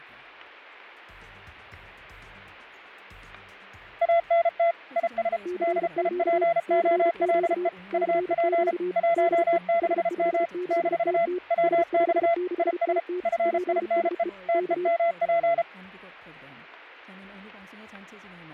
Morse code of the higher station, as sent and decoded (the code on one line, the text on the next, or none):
.- -. - / .. ... / -.. .. .--. --- .-.. . / ..- .--. / .---- -.... -- / -....- / .-- -..- / .. ... / ..-. .. -. . / - . -- .--.
ANT IS DIPOLE UP 16M - WX IS FINE TEMP